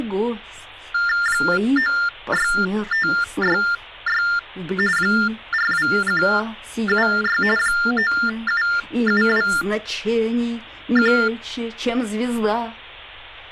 TTY/TDD text telephone tones (45.45 baud Baudot), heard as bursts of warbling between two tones, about 400 Hz shift, 1600 Hz centre. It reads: 96566 42176 97721